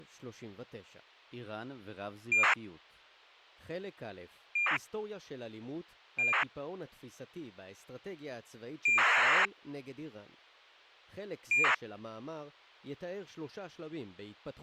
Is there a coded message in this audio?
Yes: ACARS aircraft data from 2.3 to 11.7 s, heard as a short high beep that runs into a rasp, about 2400 baud, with speech in Hebrew.